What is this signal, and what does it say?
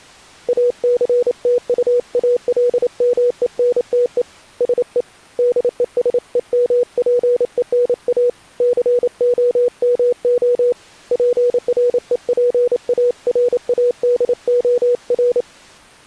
Morse code, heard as a keyed tone, hand-sent with a paddle, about 28 wpm, 490 Hz. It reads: ACTUALMENTE SE DESEMPENA COMO PREPARADOR